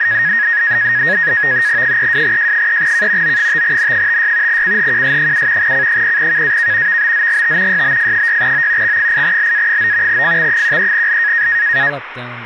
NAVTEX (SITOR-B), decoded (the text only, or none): 32J3K O5N56 CHQS7 C0KAK VBZGT YBF6O X8LA9 FX13L